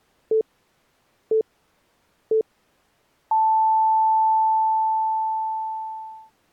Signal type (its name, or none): radio time signal